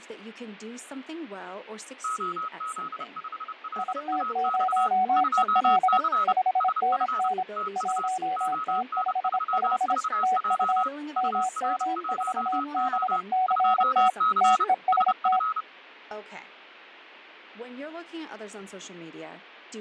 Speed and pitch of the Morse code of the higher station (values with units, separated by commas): 30 wpm, 1280 Hz